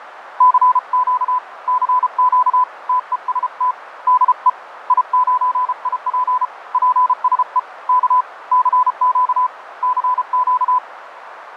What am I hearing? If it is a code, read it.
Morse code, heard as a keyed tone, hand-sent with a paddle, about 33 wpm, 1000 Hz, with radio static and fading. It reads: CQ CQ TEST DE I9IP PSE K CQ CQ